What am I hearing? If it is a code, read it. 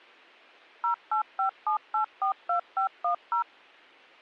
DTMF, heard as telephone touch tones, dialled by machine, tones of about 100 ms. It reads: 0857842510